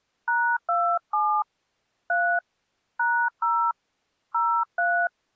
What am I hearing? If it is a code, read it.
DTMF, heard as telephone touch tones, dialled by hand, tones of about 290 ms. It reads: #27 3 #0 03